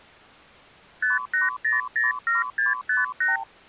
Multi-frequency trunk signalling (R2, with the far end's replies), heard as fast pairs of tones, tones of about 160 ms. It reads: 58007658